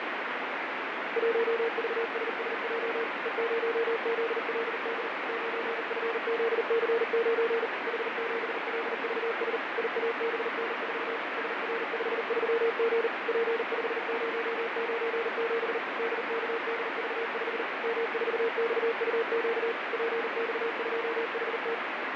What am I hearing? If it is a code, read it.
Morse code, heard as a keyed tone, machine-sent, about 39 wpm, 460 Hz, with heavy radio static and fading. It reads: 1VSSJ E0ZLD 9FZC9 H7LVS IABN4 SR53G P5097 DKDV5 M4XUQ PX2HT